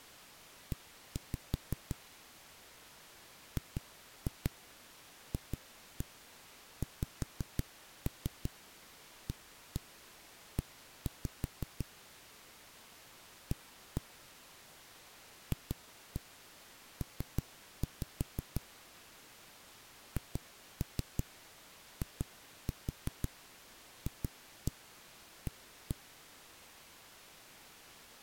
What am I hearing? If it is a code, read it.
Tap code, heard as knocks on a wall, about 5 knocks a second. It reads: E GFXAE A FP HIFA